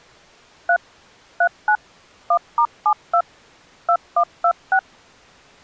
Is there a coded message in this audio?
Yes: DTMF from 0.7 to 4.8 s, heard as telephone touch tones, dialled by machine, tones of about 70 ms. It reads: 3 39 1*72 2126